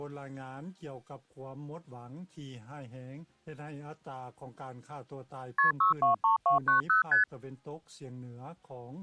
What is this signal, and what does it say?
Multi-frequency trunk signalling (R1, as on North American trunks), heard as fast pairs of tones, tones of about 130 ms. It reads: KP 623290 ST